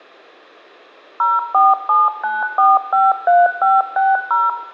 DTMF, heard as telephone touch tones, dialled by machine, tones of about 190 ms, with room echo. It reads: 0479453560